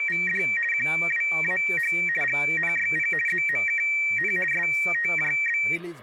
RTTY (50 baud, 450 Hz shift), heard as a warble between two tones, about 2100 Hz centre, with speech in Nepali. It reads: … QWAH GNYP ZMKN STJB